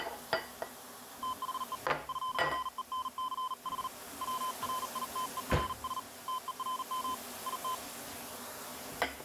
Morse code, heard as a keyed tone, hand-sent with a paddle, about 39 wpm, 1020 Hz, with kitchen noise. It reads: THE FRENCH WRITERS TERM IT